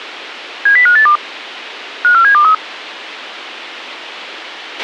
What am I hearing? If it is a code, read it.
Five-tone selective call (CCIR), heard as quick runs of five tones, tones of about 100 ms, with a squelch burst at the end. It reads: 70582 54723